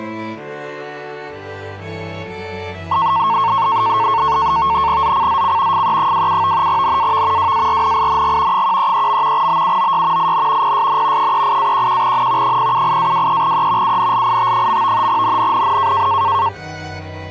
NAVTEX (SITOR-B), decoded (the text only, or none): ZCZC FE27 NAV WARNING 133. BUOY IN PSN 38-11N 078-23E UNLIT. NNNN